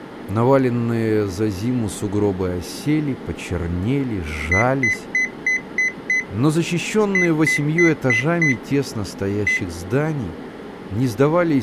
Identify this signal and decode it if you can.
Beep code, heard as a piezo beeper, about 2000 Hz, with speech in Russian. 6-5-1.